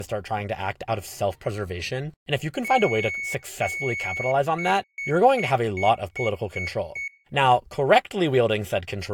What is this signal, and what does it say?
Beep code, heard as a piezo beeper, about 2200 Hz, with speech in English. 2 long, 7 short.